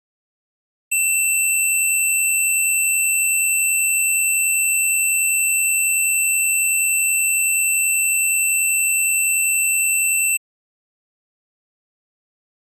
A steady tone. There is no code.